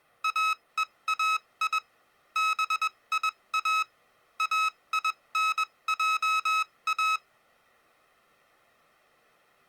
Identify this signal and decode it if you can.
Morse code (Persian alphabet), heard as electronic beeps, machine-sent, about 21 wpm, spaced as for 18 wpm, 1280 Hz. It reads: اهای بیا اینجا